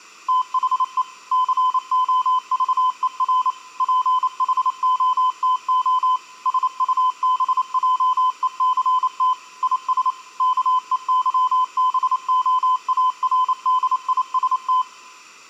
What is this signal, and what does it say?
Morse code, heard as a keyed tone, machine-sent, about 28 wpm, 1020 Hz. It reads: THE COVER PHOTO SUBJECT IS KEYBOARDIST